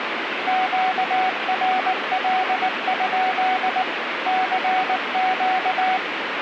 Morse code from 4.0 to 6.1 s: CQ

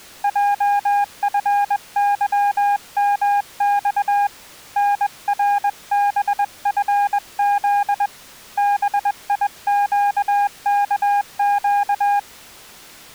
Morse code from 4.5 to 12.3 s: NRBFZ BIQKQ

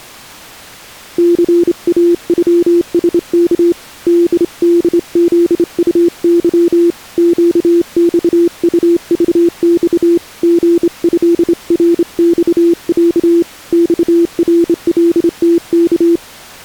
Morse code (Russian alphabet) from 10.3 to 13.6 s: ГЭРЬЯ

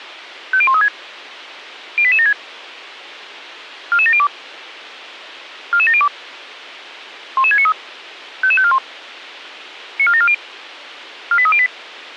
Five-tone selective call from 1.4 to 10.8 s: 08876 44702 44702 11693 55541 94740

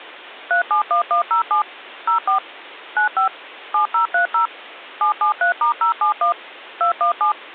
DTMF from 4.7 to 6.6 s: 773*071

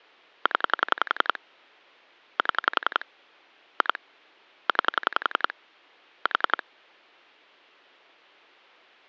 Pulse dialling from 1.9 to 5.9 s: 7 2 9

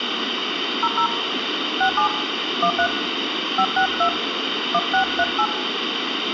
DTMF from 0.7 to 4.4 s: 00 67 13 562

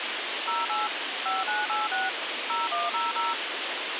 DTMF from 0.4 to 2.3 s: 08 5986

